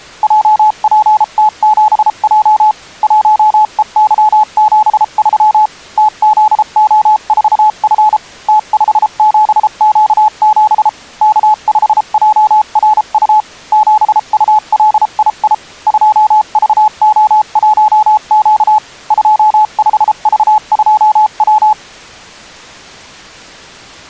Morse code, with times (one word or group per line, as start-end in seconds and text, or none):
0.2-2.7 JPT7J
3.0-5.7 1EY73
6.0-8.2 TZO4F
8.5-10.9 T57Q7
11.2-13.4 K5JRU
13.7-15.5 7ULII
15.9-18.8 2VO1Q
19.1-21.7 25V2W